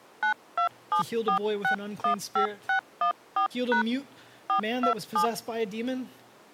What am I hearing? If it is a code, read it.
DTMF, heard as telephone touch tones, dialled by hand, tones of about 100 ms. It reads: 9274615614# 427